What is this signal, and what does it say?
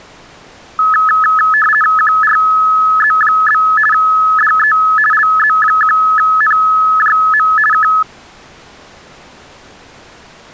RTTY (50 baud, 450 Hz shift), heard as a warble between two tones, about 1500 Hz centre. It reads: QRZ? DE LZ1NJM K